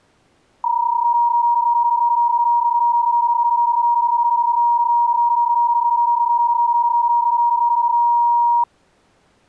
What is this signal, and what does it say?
PSK31 (31.25 baud), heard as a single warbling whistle, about 950 Hz.